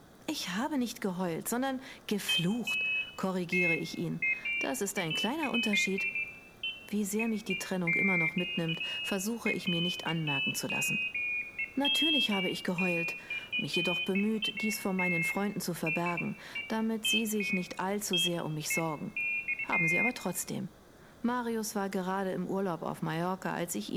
Pairs of high tones at irregular times, with room echo and speech in German. There is no code.